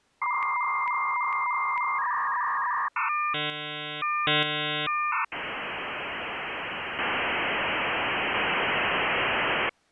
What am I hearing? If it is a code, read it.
Dial-up modem handshake (V.34 or later), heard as a whistle, warbles, then hiss.